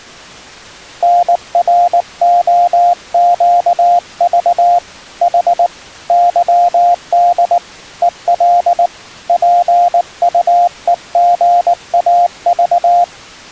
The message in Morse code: NROQV H YD EL PUEGAV

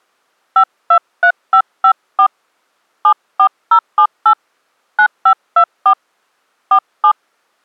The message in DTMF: 523554 74078 9524 47

